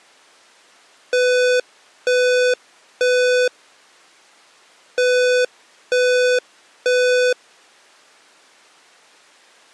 Alarm pattern, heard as an alarm's beeps, played twice, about 500 Hz. Temporal three. Smoke or fire, evacuate.